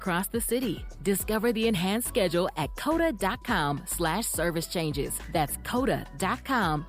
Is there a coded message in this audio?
No.